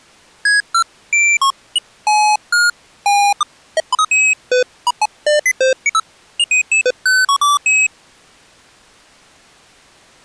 Electronic bleeps of random pitch and length. There is no code.